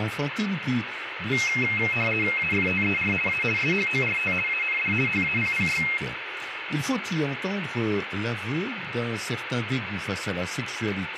RTTY (50 baud, 450 Hz shift), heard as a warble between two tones, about 2350 Hz centre, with radio static. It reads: AFTER A SHORT AND HAPPY